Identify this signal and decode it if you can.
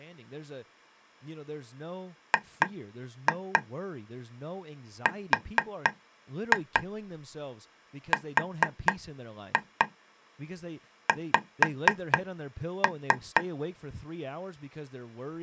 Tap code, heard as taps on a table, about 4 knocks a second, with speech in English. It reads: GRRX